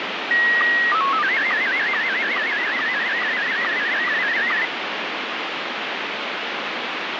SSTV (slow-scan television), Scottie S1, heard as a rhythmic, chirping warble, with heavy radio static.